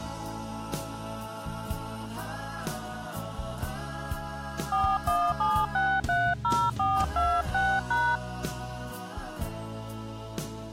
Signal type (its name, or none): DTMF